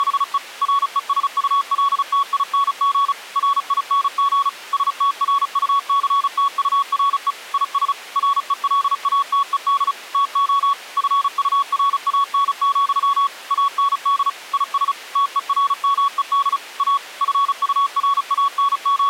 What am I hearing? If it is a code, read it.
Morse code, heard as a keyed tone, machine-sent, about 35 wpm, 1120 Hz. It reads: … RESULTING RING STRUCTURE IS RELATED TO FURAN, AND IS TERMED A …